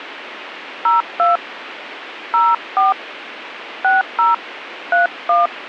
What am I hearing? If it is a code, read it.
DTMF, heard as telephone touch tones, dialled by hand, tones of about 170 ms, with radio hiss. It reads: 02 04 60 31